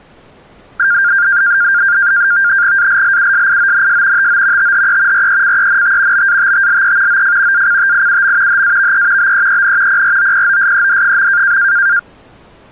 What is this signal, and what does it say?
NAVTEX (SITOR-B), 100 baud, 170 Hz shift, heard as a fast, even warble, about 1500 Hz centre. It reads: ALLUSIONS TO THE RECENT BATTLE OF ACTIUM HAVE BEEN PROPOSED.